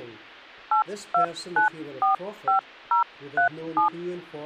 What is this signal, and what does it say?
DTMF, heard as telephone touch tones, dialled by hand, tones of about 110 ms. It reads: 82945037